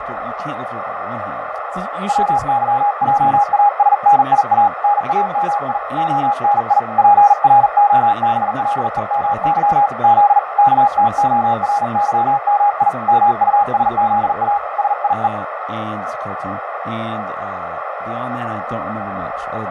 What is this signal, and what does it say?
Morse code, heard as a keyed tone, hand-sent with a paddle, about 40 wpm, 820 Hz, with radio static, fading, a narrow filter and speech in English. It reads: WYJASNIA NAMI ONI PROBLEMY Z KTORYMI MUSZA SIE